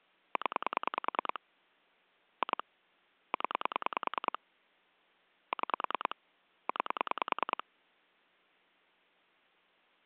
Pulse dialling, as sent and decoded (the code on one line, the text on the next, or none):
10 / 2 / 10 / 6 / 9
0 2 0 6 9